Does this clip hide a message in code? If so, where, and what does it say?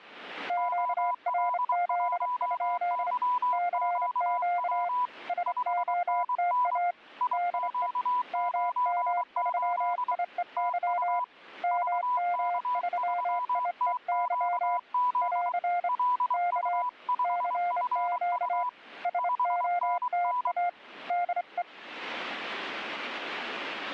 Yes: Morse code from 0.4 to 21.7 s, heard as two keyed tones. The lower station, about 27 wpm, 700 Hz: QRZ? CQ SOTA DE MM3IEY MM3IEY <AR> K CQ SOTA DE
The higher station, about 23 wpm, 990 Hz: OL1YQW 5NN IQ98 TU VK3TQZ LU5FU 5NN